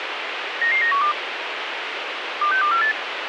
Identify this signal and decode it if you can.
Five-tone selective call (CCIR), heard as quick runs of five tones, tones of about 100 ms, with radio hiss and a squelch burst at the end. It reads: 99912 26248